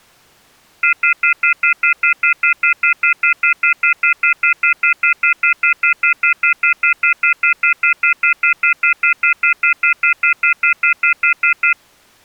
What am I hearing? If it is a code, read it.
Telephone call progress tone (North American plan), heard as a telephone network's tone, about 1400, 2050, 2450, 2600 Hz, 0.1 s on and 0.1 s off. Off-hook warning tone.